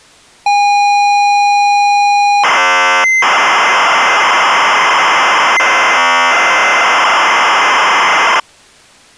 ZX Spectrum tape loading, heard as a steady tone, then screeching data.